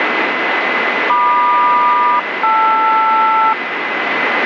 Aircraft SELCAL, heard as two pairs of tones, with radio static. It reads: MQ-LR